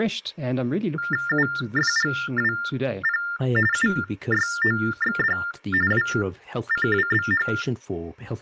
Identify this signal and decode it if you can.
TTY/TDD text telephone tones (45.45 baud Baudot), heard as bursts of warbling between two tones, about 400 Hz shift, 1600 Hz centre, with speech in English. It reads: UFGWP UYOXD WCWBH